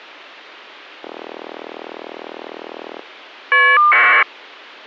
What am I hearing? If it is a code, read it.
Caller ID data burst, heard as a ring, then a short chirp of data, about 1200 baud.